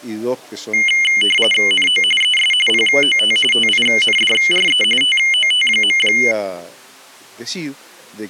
RTTY (45.45 baud, 850 Hz shift), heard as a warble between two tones, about 2550 Hz centre. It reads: NO ES POT TINDRE TOT.